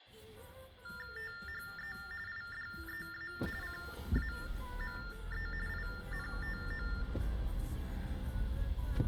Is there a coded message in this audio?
Yes: TTY/TDD text telephone tones (45.45 baud Baudot) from 0.8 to 7.0 s, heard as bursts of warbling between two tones, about 400 Hz shift, 1600 Hz centre, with room echo and the noise inside a car. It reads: THE IDEA CAME INTO